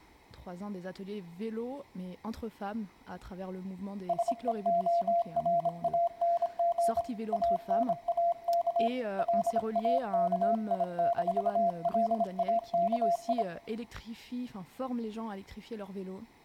Morse code, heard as a keyed tone, hand-sent with a bug key, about 26 wpm, 680 Hz, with room echo. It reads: SEORANG ANAK LAKI-LAKI